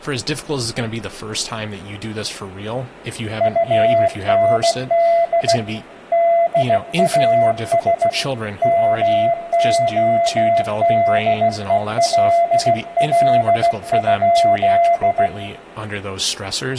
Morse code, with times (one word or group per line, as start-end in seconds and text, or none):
3.4-5.6 UND
6.1-8.1 DAS
8.6-15.3 MODELL?